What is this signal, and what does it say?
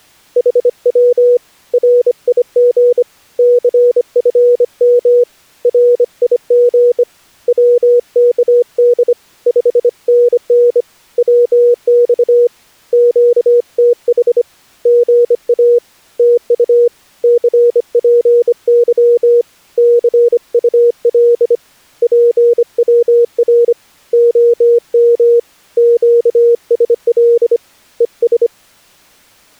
Morse code, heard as a keyed tone, hand-sent with a bug key, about 25 wpm, 480 Hz. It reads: HW RIG CFM RIG WKD 5NN WX QTH GA TU CPY CUL PWR OM QSL ES